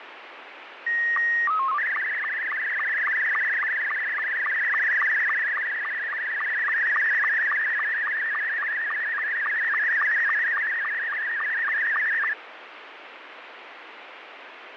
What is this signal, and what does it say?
SSTV (slow-scan television), Scottie S2, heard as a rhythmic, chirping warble, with radio static.